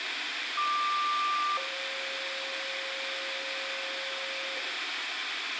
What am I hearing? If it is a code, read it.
Two-tone page, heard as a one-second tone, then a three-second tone, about 1180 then 540 Hz, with radio hiss and room echo.